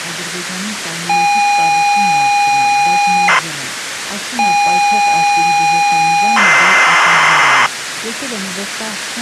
ZX Spectrum tape loading, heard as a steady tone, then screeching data, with tape hiss.